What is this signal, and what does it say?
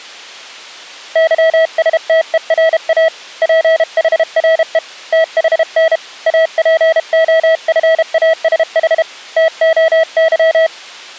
Morse code (Greek alphabet), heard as a keyed tone, hand-sent with a paddle, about 32 wpm, 650 Hz. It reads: ΥΣΤΕΡΑ ΠΗΡΕ ΤΗΝ ΑΠΟΦΑΣΗ ΤΟΥ